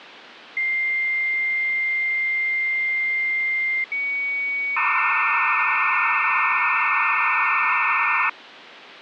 Dial-up modem handshake (low-speed, two carriers), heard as two whistles, then hiss, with phone line noise.